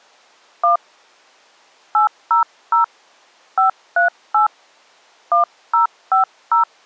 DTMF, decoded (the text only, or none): 1 800 538 1050